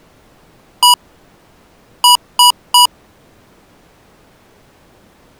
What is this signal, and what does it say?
Beep code, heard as beeps from a small speaker, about 980 Hz. 1-3.